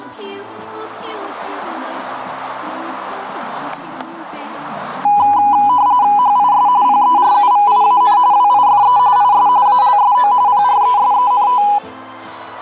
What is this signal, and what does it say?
RTTY (45.45 baud, 170 Hz shift), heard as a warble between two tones, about 910 Hz centre, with static crashes. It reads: HIS PERUVIAN WIFE IS ALSO PRESENT